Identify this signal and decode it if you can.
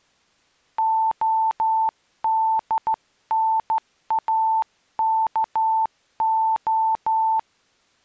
Morse code (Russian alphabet), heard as a keyed tone, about 13 wpm, 890 Hz. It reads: ОДНАКО